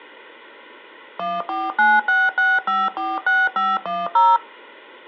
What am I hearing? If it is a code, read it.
DTMF, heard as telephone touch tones, dialled by machine, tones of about 210 ms. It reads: 14966546510